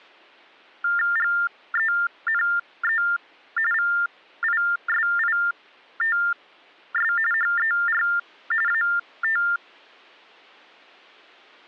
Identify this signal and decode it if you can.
TTY/TDD text telephone tones (45.45 baud Baudot), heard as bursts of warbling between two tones, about 400 Hz shift, 1600 Hz centre. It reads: GENE VISITS HER AT